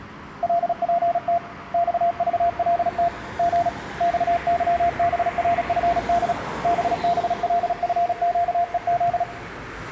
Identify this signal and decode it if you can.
Morse code, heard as a keyed tone, hand-sent with a paddle, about 36 wpm, 690 Hz, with room echo and street noise. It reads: LPT XVLT G XYBRFD BBLFQEZ